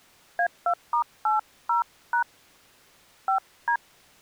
DTMF, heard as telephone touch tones, dialled by hand, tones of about 110 ms. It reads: A2*80# 5D